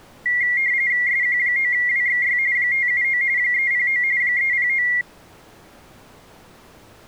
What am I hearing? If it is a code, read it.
RTTY (45.45 baud, 170 Hz shift), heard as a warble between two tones, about 2050 Hz centre. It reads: SQ9WXY 579 309 309